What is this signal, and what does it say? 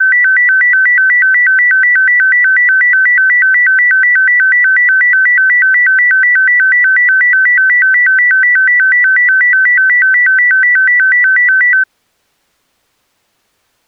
A tone that alternates evenly between two pitches. There is no code.